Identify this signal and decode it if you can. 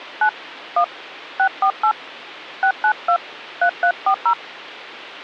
DTMF, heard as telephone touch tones, dialled by hand, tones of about 80 ms, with hum. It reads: 9 1 648 692 3340